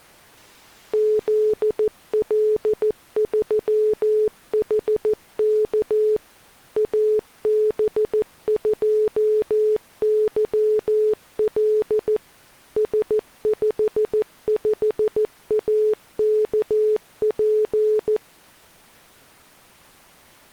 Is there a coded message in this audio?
Yes: Morse code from 0.9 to 18.2 s, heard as a keyed tone, machine-sent, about 14 wpm, 430 Hz. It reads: ZL3HK AB2YL S55AKP